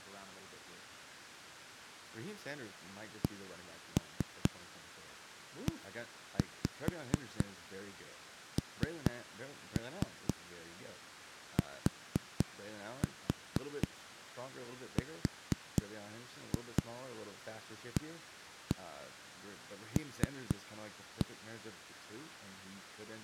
Tap code, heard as knocks on a wall, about 4 knocks a second, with speech in English. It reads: CENTRAL